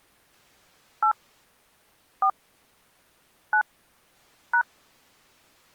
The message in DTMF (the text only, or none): 8 4 9 #